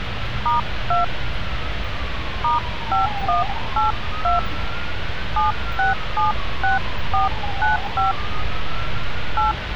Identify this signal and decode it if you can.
DTMF, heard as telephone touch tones, dialled by hand, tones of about 140 ms, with phone line noise and street noise. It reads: *2 *5182 7676495 8